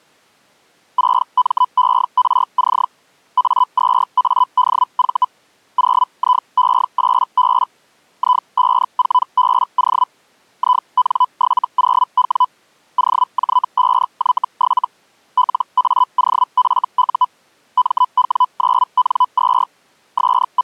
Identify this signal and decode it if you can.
Hellschreiber (Feld-Hell, 122.5 baud), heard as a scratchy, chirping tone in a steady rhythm, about 1000 Hz. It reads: 6MERC A2ADV 0IE8B I54BO IN70W OJ5Y7 LAOFU MW9N2 …